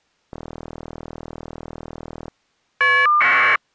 Caller ID data burst, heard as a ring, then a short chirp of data, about 1200 baud.